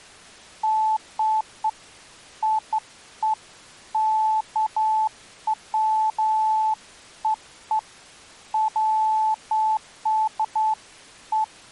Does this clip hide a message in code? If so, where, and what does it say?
No, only beeps of irregular length.